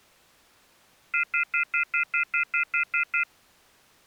Telephone call progress tone (North American plan), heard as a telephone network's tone, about 1400, 2050, 2450, 2600 Hz, 0.1 s on and 0.1 s off. Off-hook warning tone.